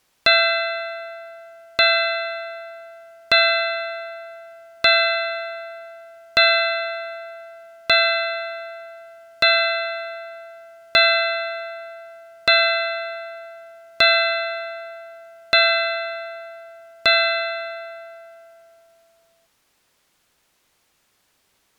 Clock strike, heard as a bell. 12. Twelve o'clock.